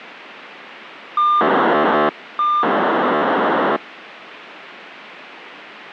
POCSAG pager data (2400 baud), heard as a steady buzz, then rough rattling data, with radio hiss.